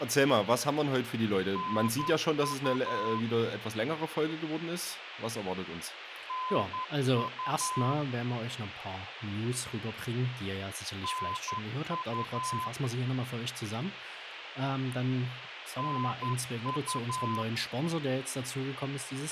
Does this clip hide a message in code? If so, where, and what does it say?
Yes: Morse code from 1.5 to 17.5 s, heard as a keyed tone, machine-sent, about 11 wpm, 1020 Hz, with radio hiss and a squelch burst at the end. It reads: NU NU NU NU